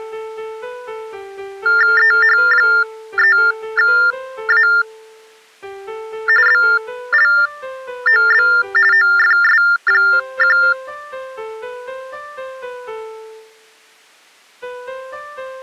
TTY/TDD text telephone tones (45.45 baud Baudot), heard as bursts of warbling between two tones, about 400 Hz shift, 1600 Hz centre. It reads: EH3A BLOB OFS1